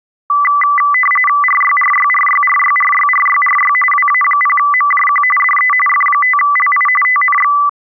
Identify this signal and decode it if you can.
RTTY (45.45 baud, 850 Hz shift), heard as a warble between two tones, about 1600 Hz centre. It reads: RYRYRYRYRYRYRY WA0MJQ DE F5LI TNX